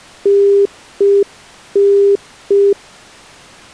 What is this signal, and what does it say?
Telephone call progress tone (UK plan), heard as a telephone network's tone, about 400 Hz. Congestion tone.